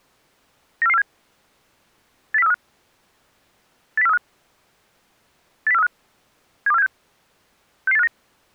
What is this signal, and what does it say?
Five-tone selective call (EEA), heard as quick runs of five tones, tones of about 40 ms. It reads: 94447 80435 80435 80435 72476 66859